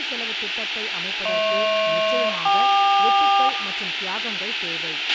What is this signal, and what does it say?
Aircraft SELCAL, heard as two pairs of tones, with radio hiss, a squelch burst at the end, room echo and speech in Tamil. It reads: HP-KQ